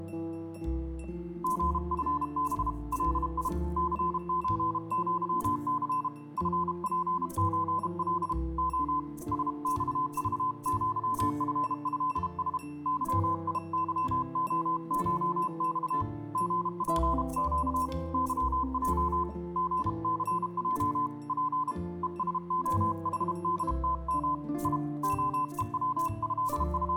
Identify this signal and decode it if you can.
Morse code (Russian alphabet), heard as a keyed tone, hand-sent with a paddle, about 32 wpm, 1020 Hz. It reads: ГФБ ЛИ ЦЧЪЦ ФПЧЛ О СЬЖЪФЭС ЫИЫОШЬ ГПЩ ЫЙ ГЦЙ П ЕСОХДТМ И …